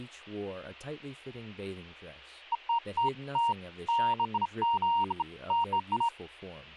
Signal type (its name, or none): none